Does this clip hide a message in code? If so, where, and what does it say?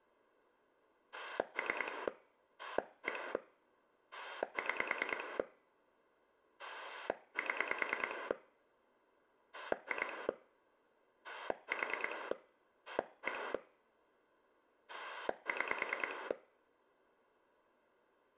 Yes: pulse dialling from 1.1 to 16.3 s, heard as a rotary dial, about 9 pulses a second, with room echo. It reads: 3 1 6 7 2 4 1 6